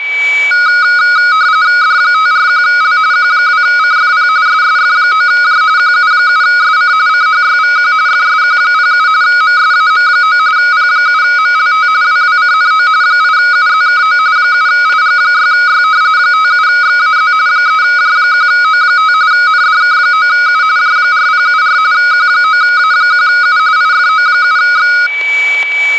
RTTY (45.45 baud, 170 Hz shift), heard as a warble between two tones, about 1360 Hz centre, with static crashes and a steady whistle near 2290 Hz. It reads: D541L Q2CFP SSF9J QU7SC CHYVQ FSQ07 MSAM9 P7MLT WWCNO 8UZKO 7IG6Y 57XAZ 3J1O5 NDK9U J4074 Q9A1U IFO7X